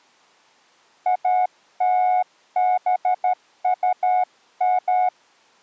Morse code (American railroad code), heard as a keyed tone, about 730 Hz. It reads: ALBUM